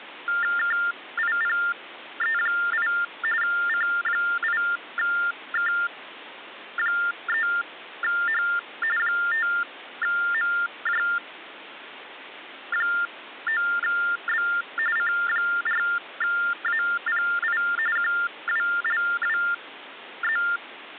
TTY/TDD text telephone tones (45.45 baud Baudot), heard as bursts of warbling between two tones, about 400 Hz shift, 1600 Hz centre, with phone line noise. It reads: KIPE8 C8K3H 5MJ9B C4API QWLWZ